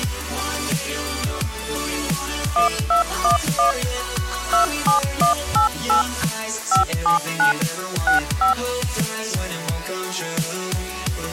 DTMF, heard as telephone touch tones, dialled by machine, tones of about 120 ms. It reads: 1211 27188 579 65